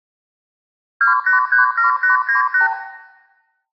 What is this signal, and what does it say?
Multi-frequency trunk signalling (R2, with the far end's replies), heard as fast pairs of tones, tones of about 130 ms, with room echo. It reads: 2837898